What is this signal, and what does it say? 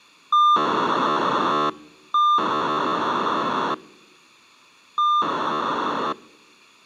POCSAG pager data (2400 baud), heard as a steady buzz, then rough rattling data.